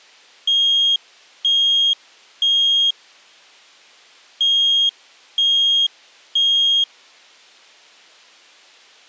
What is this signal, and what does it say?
Alarm pattern, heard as an alarm's beeps, played twice, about 3250 Hz. Temporal three. Smoke or fire, evacuate.